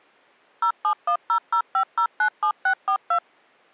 DTMF, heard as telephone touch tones, dialled by machine, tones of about 80 ms. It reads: 071005097642